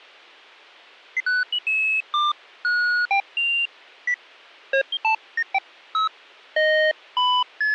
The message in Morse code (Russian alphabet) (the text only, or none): none